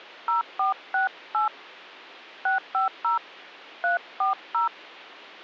DTMF, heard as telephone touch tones, dialled by hand, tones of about 130 ms. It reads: 0468 650 340